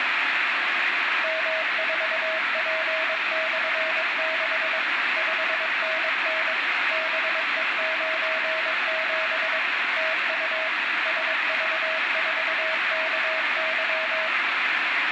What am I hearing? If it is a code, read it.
Morse code, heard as a keyed tone, machine-sent, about 22 wpm, 640 Hz, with heavy radio static and room echo. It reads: M4P/6 5NN BE97 TU SV4KY